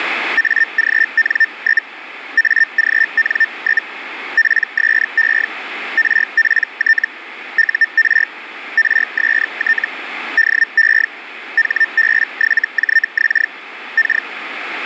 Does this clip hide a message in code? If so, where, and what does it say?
Yes: Hellschreiber (Feld-Hell, 122.5 baud) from 0.4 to 14.3 s, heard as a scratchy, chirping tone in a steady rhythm, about 1800 Hz, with radio static. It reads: AGN? AGN? PSE RPT UR RST DE HB7JX K